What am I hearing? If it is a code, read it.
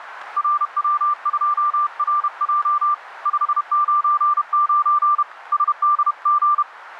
Morse code, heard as a keyed tone, hand-sent with a paddle, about 31 wpm, 1180 Hz, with radio static. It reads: RW2RJ 599 SDG